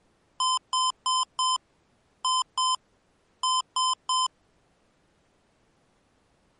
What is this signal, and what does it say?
Beep code, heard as beeps from a small speaker, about 1030 Hz. 4-2-3. In Phoenix BIOS tables: gate A20 failure.